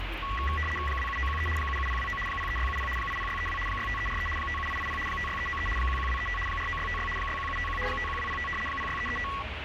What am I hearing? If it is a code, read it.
RTTY (75 baud, 850 Hz shift), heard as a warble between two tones, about 1550 Hz centre, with radio static and the noise of a residential street. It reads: 27913 77029 03670 80632 65343 57880 56393 11235 49656 61751 51205 06335